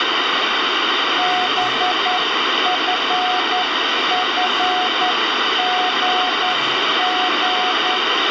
Morse code, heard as a keyed tone, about 10 wpm, 730 Hz, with heavy radio static and the noise of a cafe. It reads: BFFGG